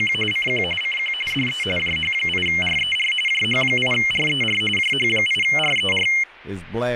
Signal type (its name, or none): RTTY